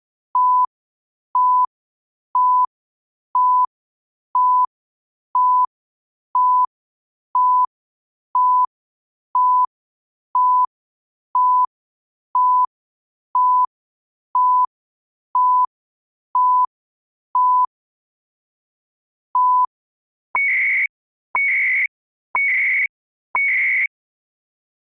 Radio time signal (CHU, Canada), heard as beeps and data bursts, one a second.